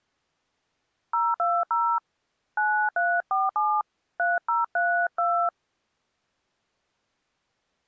DTMF, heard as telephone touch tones, dialled by hand, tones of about 220 ms. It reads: 020 9347 3032